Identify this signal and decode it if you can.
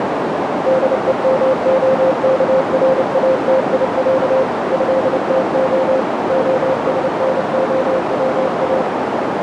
Morse code (Russian alphabet), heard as a keyed tone, machine-sent, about 29 wpm, 520 Hz, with heavy radio static and a narrow filter. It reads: ДЕМОКРАТИЯ ЭТО ОСНОВА